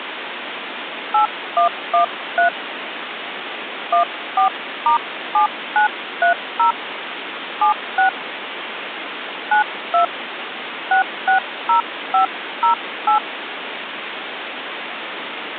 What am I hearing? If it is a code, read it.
DTMF, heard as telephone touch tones, dialled by hand, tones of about 110 ms, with phone line noise. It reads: 8113 14*7930 76 92 660508